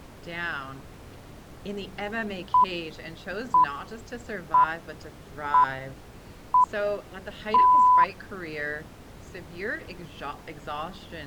Radio time signal (six pips, as the Greenwich Time Signal), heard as pips.